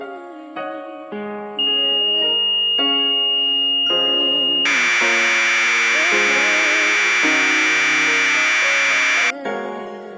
Commodore tape loading (standard loader), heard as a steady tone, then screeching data.